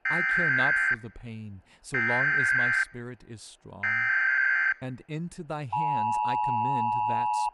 Emergency Alert System (SAME) tones (header bursts, then the 853 and 960 Hz attention tone), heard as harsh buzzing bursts, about 520.83 baud, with speech in English.